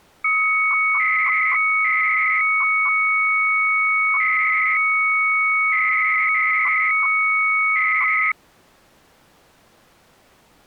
300-baud modem data (Bell 103 tones), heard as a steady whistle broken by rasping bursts, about 300 baud, 200 Hz shift.